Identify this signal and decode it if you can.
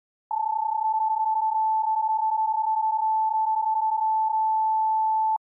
PSK31 (31.25 baud), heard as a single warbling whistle, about 880 Hz.